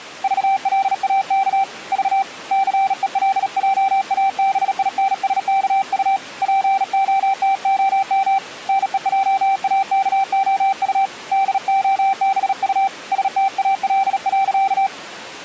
Morse code, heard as a keyed tone, hand-sent with a bug key, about 37 wpm, 780 Hz. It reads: VLAK V CELJABINSKU POTOM NEJAKOU DOBU STAL.